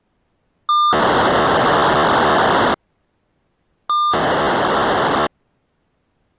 POCSAG pager data (2400 baud), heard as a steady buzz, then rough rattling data.